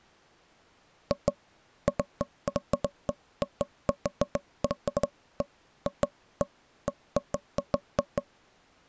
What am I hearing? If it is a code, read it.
Irregular knocks on wood. There is no code.